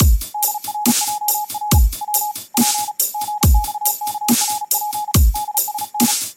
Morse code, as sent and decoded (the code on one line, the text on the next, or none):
-.. .-. .--- .-. / .-- / .--. / --. -..- -.- .-. .--. / -.. ... -.
DRJR W P GXKRP DSN